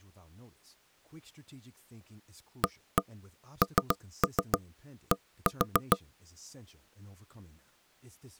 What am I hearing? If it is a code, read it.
Tap code, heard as knocks on wood, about 7 knocks a second, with speech in English. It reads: AND